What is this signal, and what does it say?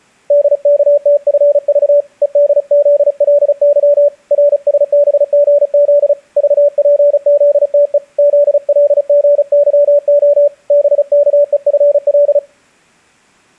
Morse code, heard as a keyed tone, hand-sent with a paddle, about 35 wpm, 580 Hz. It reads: DKTFV EDZLY RSBGZ VPZTE ZLGYO BKEFL